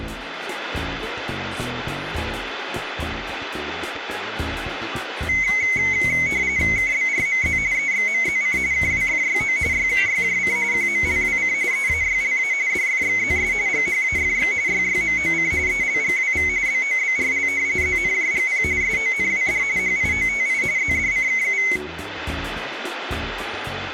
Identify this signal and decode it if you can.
RTTY (45.45 baud, 170 Hz shift), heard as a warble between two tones, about 2150 Hz centre. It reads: KBRMZ EXMZC KWFYO YKYJC QMLWC EAYLA DFXZS GHAFX YYMOC ELGWV BOBRL ZNJGP SONWD HIOTI ZDCKU